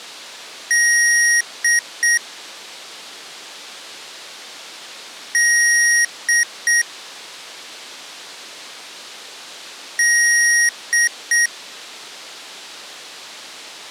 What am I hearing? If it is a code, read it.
Beep code, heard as beeps from a small speaker, played three times, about 1900 Hz. 1 long, 2 short. In Award, IBM and AMI BIOS tables: video adapter failure.